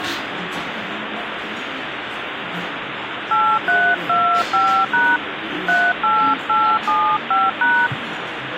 DTMF, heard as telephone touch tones, dialled by hand, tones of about 250 ms, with phone line noise and the noise of a restaurant. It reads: 8325# 38875#